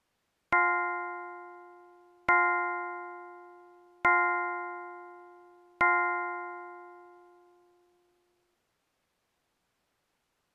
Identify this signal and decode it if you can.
Clock strike, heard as a bell. 4. Four o'clock.